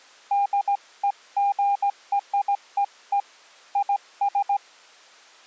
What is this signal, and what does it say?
Morse code (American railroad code), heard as a keyed tone, hand-sent with a straight key, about 800 Hz. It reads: DEGREE IS